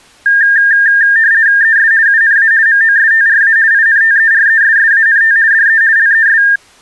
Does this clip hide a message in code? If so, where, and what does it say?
Yes: RTTY (50 baud, 170 Hz shift) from 0.3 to 6.6 s, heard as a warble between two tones, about 1700 Hz centre. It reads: ES UNA MOSTRA INTERESSANT DE LES